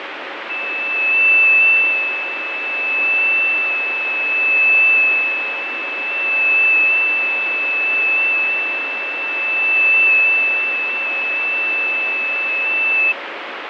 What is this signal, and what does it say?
FT8 (one signal), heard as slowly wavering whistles, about 6.25 baud, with radio static and fading.